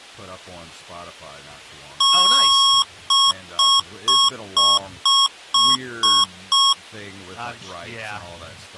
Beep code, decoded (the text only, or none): 1 long, 8 short